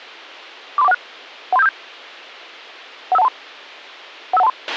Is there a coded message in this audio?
Yes: five-tone selective call (EIA) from 0.8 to 4.5 s, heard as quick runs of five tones, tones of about 30 ms, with a squelch burst at the end. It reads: 43416 13757 15123 15123